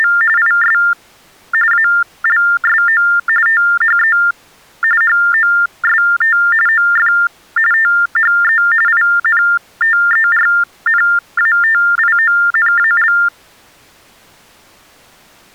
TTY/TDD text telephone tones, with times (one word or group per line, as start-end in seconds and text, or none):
0.0-0.1 …
0.4-0.8 IS
1.7-3.0 ALSO
3.5-4.2 THE
5.0-6.4 HOST
6.7-7.1 OF
7.7-8.6 THE
8.9-13.1 INTERNATIONAL